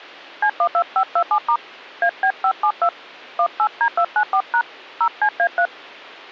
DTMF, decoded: C12527* AB572 18D294# 0CA3

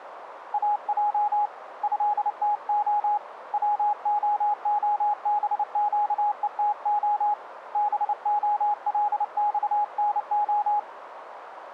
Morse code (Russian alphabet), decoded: АЙ ЭТО ВООБЩЕТО БОЛЬНО

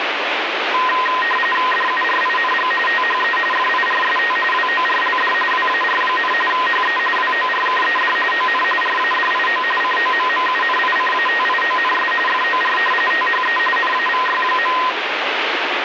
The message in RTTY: DURING THE FIRST WORLD WAR, HE WORKED ON RADIO COMMUNICATIONS FOR THE NAVY.

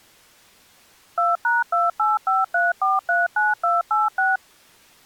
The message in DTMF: 2#2853439286

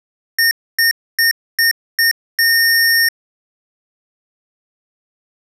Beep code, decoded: 5 short, 1 long

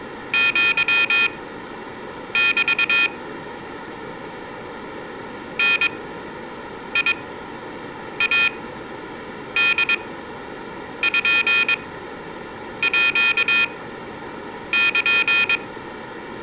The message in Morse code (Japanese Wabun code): アメ ダイポール

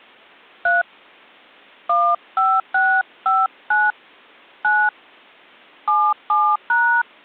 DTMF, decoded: 3 15659 9 77#

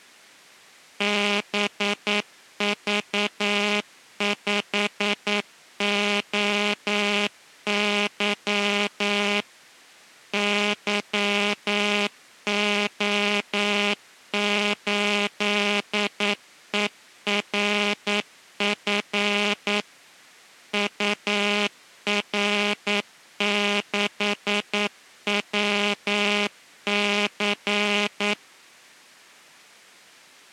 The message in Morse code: BV5OY YO8ERF UR6WC

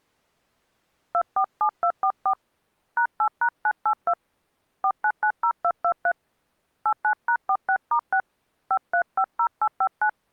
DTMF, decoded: 247244 #8#982 4990223 89#46*6 5350859

